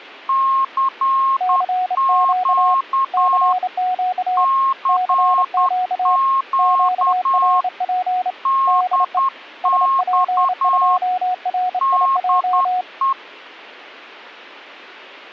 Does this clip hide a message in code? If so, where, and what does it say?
Yes: Morse code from 0.2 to 13.2 s, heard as two keyed tones. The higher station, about 10 wpm, 1080 Hz: CQ CQ DX DE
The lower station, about 28 wpm, 730 Hz: CQ CQ CQ QRP DE SP2RIJ